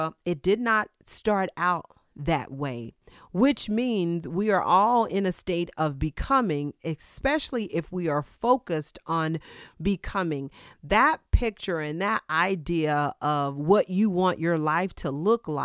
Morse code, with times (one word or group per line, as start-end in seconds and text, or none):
none